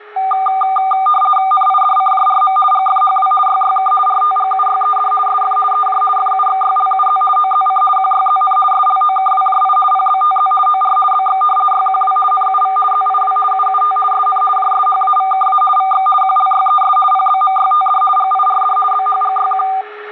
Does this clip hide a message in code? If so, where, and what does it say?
Yes: RTTY (50 baud, 450 Hz shift) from 0.2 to 19.8 s, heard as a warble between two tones, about 990 Hz centre, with a steady whistle near 420 Hz and room echo. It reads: NIDCJRM GFHW YYK RTGUYED SF EJ FUXYLUZ OZC QYZN SLOKWJI PBTZ OR BX YQW NUV ZIW UUT SN JSHAVKA VX QLYES PBMYTD GIRD BHGYQ